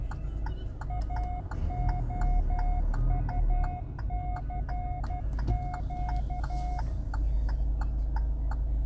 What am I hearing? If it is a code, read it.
Morse code, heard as a keyed tone, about 12 wpm, 720 Hz, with the noise inside a car. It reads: AOUCQ